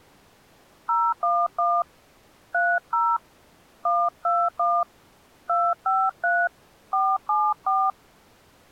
DTMF, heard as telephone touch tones, dialled by hand, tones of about 240 ms. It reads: 011 30 121 253 474